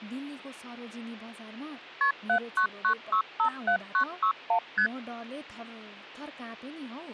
Multi-frequency trunk signalling (R1, as on North American trunks), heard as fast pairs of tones, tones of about 90 ms, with hum and speech in Nepali. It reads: KP 799657961 ST